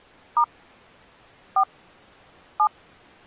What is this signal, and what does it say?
DTMF, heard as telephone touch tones, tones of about 80 ms. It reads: * 4 7